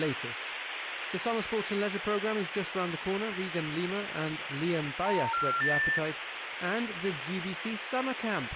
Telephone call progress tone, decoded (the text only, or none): special information tone